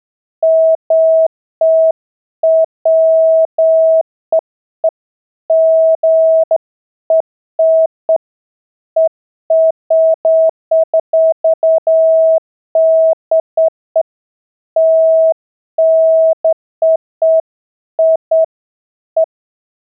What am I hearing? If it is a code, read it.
Beeps of irregular length. There is no code.